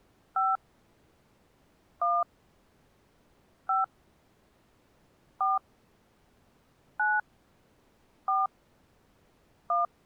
DTMF, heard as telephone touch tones, dialled by hand, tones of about 190 ms. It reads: 5 1 5 4 9 4 1